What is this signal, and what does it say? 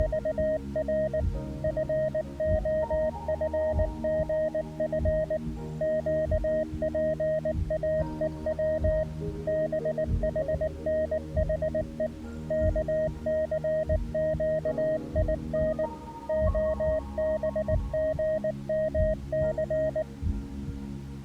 Morse code, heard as a keyed tone, machine-sent, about 19 wpm, 620 Hz. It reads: … FOFGF QPAEW BHNHE KCQIN OBGMC